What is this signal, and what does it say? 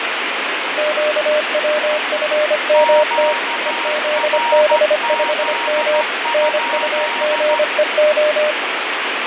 Morse code, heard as two keyed tones, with heavy radio static and fading. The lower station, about 25 wpm, 600 Hz: QWFMT EZB5M NUGEO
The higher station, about 14 wpm, 940 Hz: QRZ?